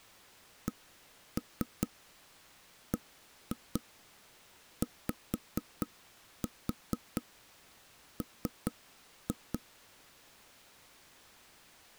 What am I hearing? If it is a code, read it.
Tap code, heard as taps on a table, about 4 knocks a second. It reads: CBYM